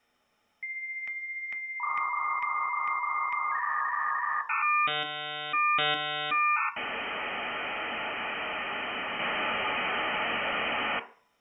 Dial-up modem handshake (V.34 or later), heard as a whistle, warbles, then hiss, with room echo.